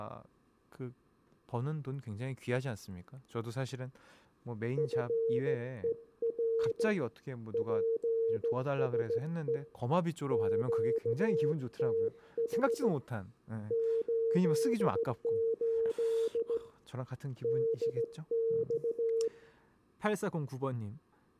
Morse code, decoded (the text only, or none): FER PSE QTH 88 DX